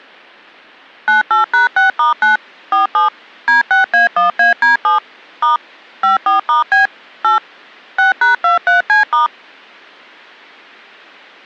DTMF, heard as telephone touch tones, dialled by machine, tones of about 140 ms. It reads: 98#6*9 47 D6A1AD7 * 54*B 8 6#23C*